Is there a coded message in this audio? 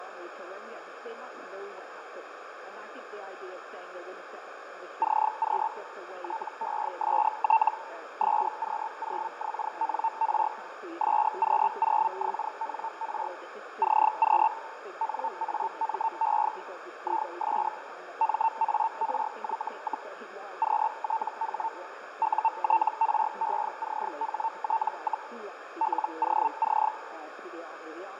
Yes: Hellschreiber (Feld-Hell, 122.5 baud) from 5.0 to 26.9 s, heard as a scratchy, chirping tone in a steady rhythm, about 900 Hz, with radio static, fading and a narrow filter. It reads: CQ TEST SQ0XNR SQ0XNR CQ NAME IS MARY, QTH UTRECHT, LOC